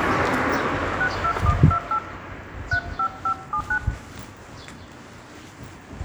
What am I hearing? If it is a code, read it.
DTMF, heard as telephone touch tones, dialled by hand, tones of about 80 ms, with the noise of a residential street. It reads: 62128 35579